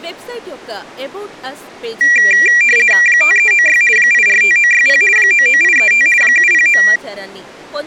RTTY (50 baud, 450 Hz shift), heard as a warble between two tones, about 2150 Hz centre, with speech in Telugu. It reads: 5396 845960 99835 709